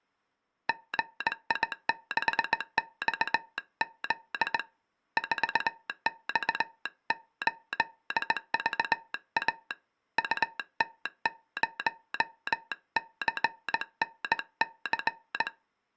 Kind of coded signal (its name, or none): Morse code